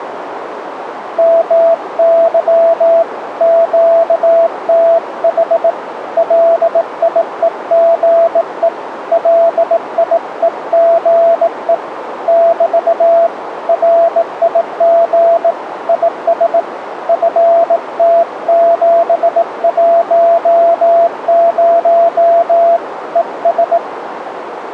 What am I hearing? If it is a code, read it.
Morse code, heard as a keyed tone, hand-sent with a bug key, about 18 wpm, 670 Hz, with radio static and a narrow filter. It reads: MY QTH LIEGE LIEGE <BT> RIG IS FT710 ES